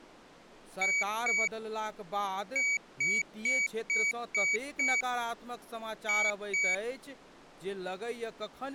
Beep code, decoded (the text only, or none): 2-6-2